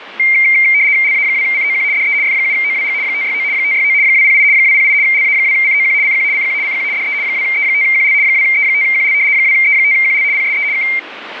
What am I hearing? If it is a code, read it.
RTTY (75 baud, 170 Hz shift), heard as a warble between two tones, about 2200 Hz centre, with radio static. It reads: LA2COQ DE F7OWG 569 569 208 208 LA2COQ CQ CQ CQ DE 2E5QL 2E5QL 2E5QL PSE K